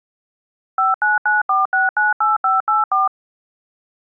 DTMF, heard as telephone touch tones, dialled by machine, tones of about 160 ms. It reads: 5994698584